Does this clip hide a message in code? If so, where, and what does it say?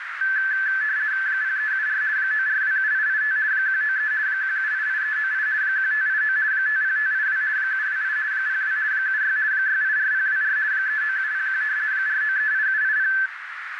Yes: RTTY (50 baud, 170 Hz shift) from 0.2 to 13.3 s, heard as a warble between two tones, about 1650 Hz centre, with radio static and a narrow filter. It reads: 0374 9427885 193 1788398 1589 50582 728 02 76 684024 39701 4938780